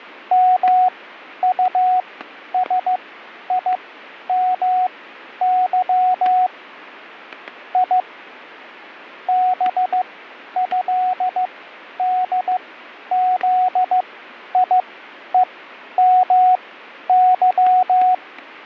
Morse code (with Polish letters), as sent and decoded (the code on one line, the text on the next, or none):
-- ..- ... .. -- -.-- / .. / -... ..-.. -.. --.. .. . -- -.--
MUSIMY I BĘDZIEMY